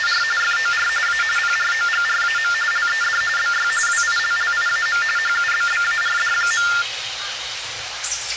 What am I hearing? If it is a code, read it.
TTY/TDD text telephone tones (45.45 baud Baudot), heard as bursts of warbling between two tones, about 400 Hz shift, 1600 Hz centre, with hum and the noise of a park. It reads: … FOR A PROGRAM LED BY WILLIAM HUBBARD.